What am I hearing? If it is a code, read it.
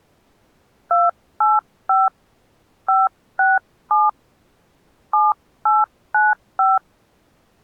DTMF, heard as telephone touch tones, dialled by hand, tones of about 190 ms. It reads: 285 567 7895